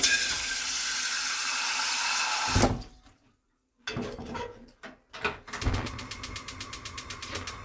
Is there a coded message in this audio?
No, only kitchen noise.